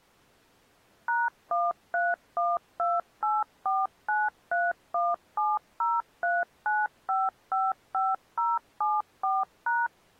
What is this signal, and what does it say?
DTMF, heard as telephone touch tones, dialled by machine, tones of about 200 ms. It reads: #1312849317039555074#